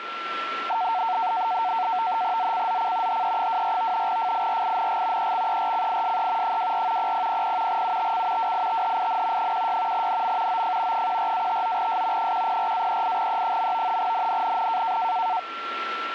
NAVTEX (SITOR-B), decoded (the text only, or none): ZCZC HE24 FIRING EXERCISE 24 0000 UTC WITHIN 16 NM OF 14-59S 104-38E. NNNN